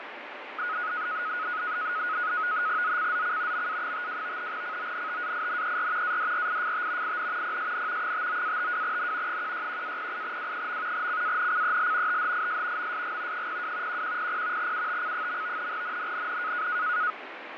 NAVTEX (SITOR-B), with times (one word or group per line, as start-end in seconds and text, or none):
2.8-3.7 ZCZC
3.5-4.5 MA52
4.5-6.2 CONTAINER
6.0-7.2 ADRIFT
7.0-7.6 IN
7.4-8.1 PSN
8.0-9.4 59-52N
9.3-11.1 161-08W.
10.9-12.2 CANCEL
12.1-12.9 THIS
12.8-13.5 MSG
13.3-14.0 02
13.9-14.7 1100
14.6-15.7 UTC.
15.7-16.7 NNNN